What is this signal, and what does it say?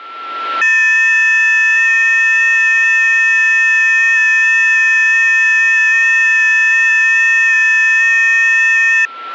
FT8 (several signals at once), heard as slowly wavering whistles, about 6.25 baud, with a steady whistle near 1350 Hz.